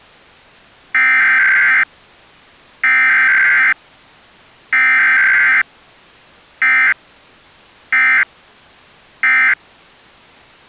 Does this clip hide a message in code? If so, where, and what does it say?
Yes: Emergency Alert System (SAME) tones (header bursts, then end-of-message bursts) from 0.9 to 9.5 s, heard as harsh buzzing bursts, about 520.83 baud.